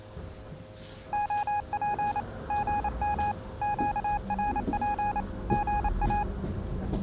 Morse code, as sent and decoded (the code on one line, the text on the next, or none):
--- .--. / --. -- / --.- .-. .--. / --. .-
OP GM QRP GA